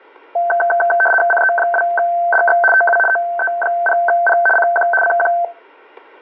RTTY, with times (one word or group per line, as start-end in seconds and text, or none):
1.3-2.6 CE2DX
2.7-3.0 TU
3.1-4.4 OE0P
4.6-4.9 CQ
5.0-5.3 CQ